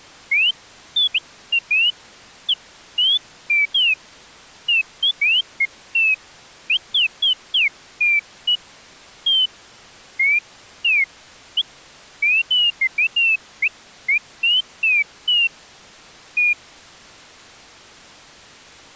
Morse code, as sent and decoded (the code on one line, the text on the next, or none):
none